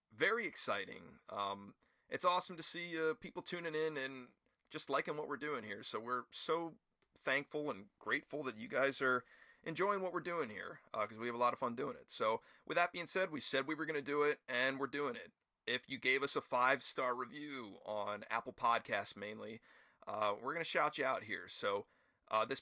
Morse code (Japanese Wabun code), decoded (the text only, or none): none